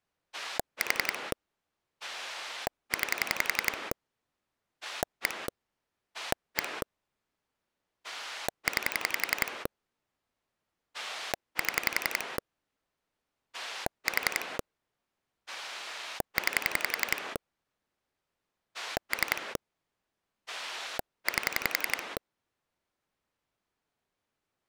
Pulse dialling, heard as a rotary dial, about 11 pulses a second. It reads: 4 9 1 1 9 7 4 9 3 8